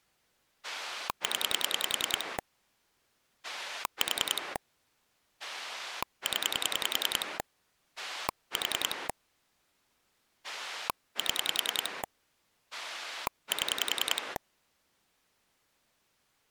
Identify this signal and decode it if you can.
Pulse dialling, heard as a rotary dial, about 10 pulses a second. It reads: 0 4 0 4 7 7